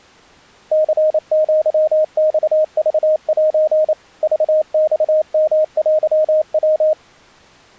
Morse code (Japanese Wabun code), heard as a keyed tone, machine-sent, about 28 wpm, 620 Hz. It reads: ニアマクセ クマヨテヤ